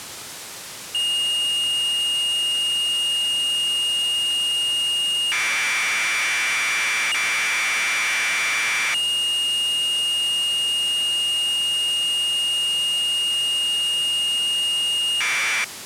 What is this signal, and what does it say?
Commodore tape loading (standard loader), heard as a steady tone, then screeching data, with tape hiss.